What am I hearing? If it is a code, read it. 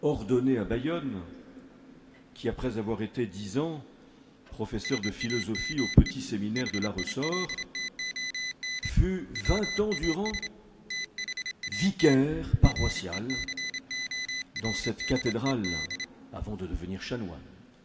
Morse code, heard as a high beeper, hand-sent with a straight key, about 27 wpm, 2000 Hz. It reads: SAME HILTON WAS THAT RECORDED